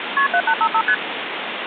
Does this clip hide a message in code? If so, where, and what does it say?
Yes: multi-frequency trunk signalling (R1, as on North American trunks) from 0.2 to 0.9 s, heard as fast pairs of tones, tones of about 70 ms, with phone line noise. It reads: KP 7855 ST